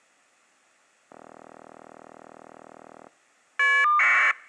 Caller ID data burst, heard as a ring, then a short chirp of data, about 1200 baud.